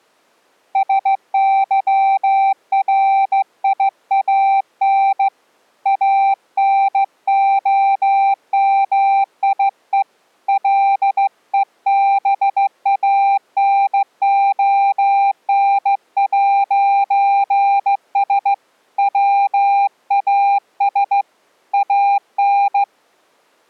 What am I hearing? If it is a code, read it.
Morse code, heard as a keyed tone, hand-sent with a straight key, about 15 wpm, 790 Hz. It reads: SYRIAN ANOMIE LEBANON'S WAS AN